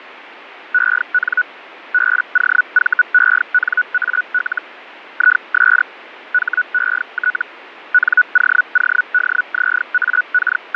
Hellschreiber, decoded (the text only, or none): EN BOVENAL IS HET …